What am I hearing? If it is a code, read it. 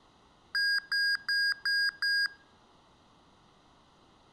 Beep code, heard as beeps from a small speaker, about 1650 Hz. 5 short. In AMI BIOS tables: processor failure; in Dell tables: CMOS battery failure.